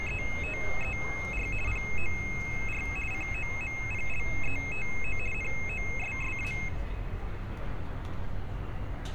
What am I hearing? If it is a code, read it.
RTTY (50 baud, 450 Hz shift), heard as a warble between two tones, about 2350 Hz centre, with street noise. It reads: … POR COMPLETO NOSSA